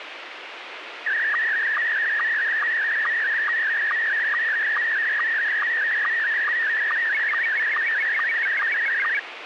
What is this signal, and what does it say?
SSTV (slow-scan television), Scottie S1, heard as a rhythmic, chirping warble, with radio hiss.